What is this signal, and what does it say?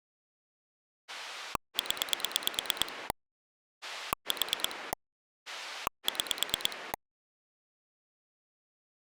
Pulse dialling, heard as a rotary dial, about 9 pulses a second. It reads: 0 4 6